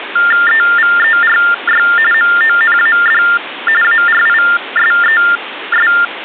TTY/TDD text telephone tones (45.45 baud Baudot), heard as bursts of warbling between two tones, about 400 Hz shift, 1600 Hz centre, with phone line noise. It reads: EVERY MONAD ARISES